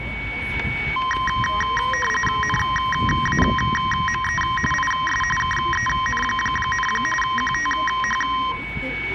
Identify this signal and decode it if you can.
RTTY (45.45 baud, 850 Hz shift), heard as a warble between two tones, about 1460 Hz centre, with static crashes, a steady whistle near 2240 Hz and the noise of a residential street. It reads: NAME IS KEN, QTH